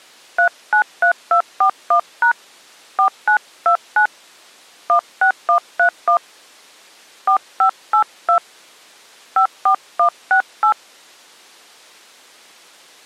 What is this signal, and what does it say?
DTMF, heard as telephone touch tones, dialled by hand, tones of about 90 ms. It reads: 393241# 4929 16131 4582 54168